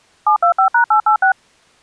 DTMF, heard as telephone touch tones, dialled by machine, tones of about 100 ms. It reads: 725#886